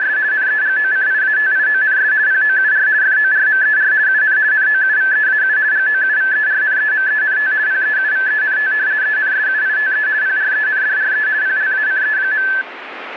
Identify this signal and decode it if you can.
RTTY (50 baud, 170 Hz shift), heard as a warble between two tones, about 1650 Hz centre, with radio static. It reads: … NEGOCIATIONS POUR FORMER UN NOUVEAU GOUVERNEMENT PEUVENT ENSUITE PRENDRE PLACE.